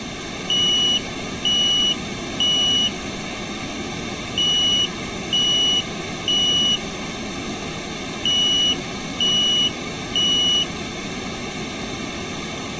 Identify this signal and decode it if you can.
Alarm pattern, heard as an alarm's beeps, played three times, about 2950 Hz. Temporal three. Smoke or fire, evacuate.